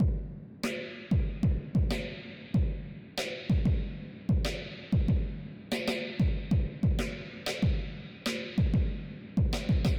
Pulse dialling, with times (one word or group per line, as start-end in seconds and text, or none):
none